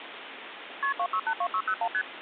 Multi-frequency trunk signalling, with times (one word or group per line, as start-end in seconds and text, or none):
0.8-0.9 KP
1.0-1.9 2682601
1.9-2.0 ST